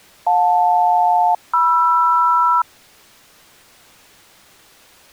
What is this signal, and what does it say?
Aircraft SELCAL, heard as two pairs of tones. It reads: JL-MR